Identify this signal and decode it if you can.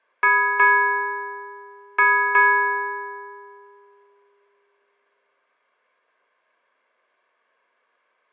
Ship's bell, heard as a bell, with room echo. 4. Four half-hours of the watch have passed.